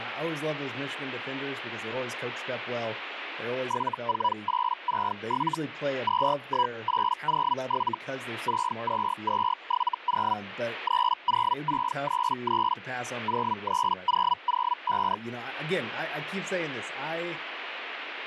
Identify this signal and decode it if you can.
Hellschreiber (Feld-Hell, 122.5 baud), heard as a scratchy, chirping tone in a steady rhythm, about 980 Hz, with radio static and speech in English. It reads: 74867 21807 62270 30633 03005